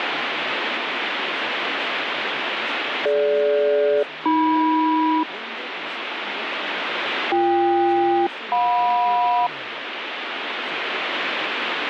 Aircraft SELCAL, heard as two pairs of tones, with radio static. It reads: DG-AM BK-JM